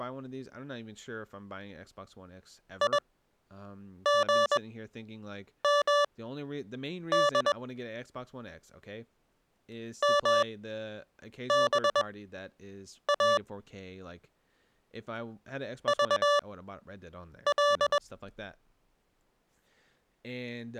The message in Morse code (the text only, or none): IGMD MBA VL